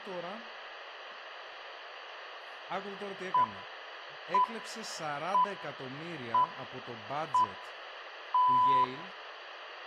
Radio time signal (six pips, as the Greenwich Time Signal), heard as pips, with room echo and speech in Greek.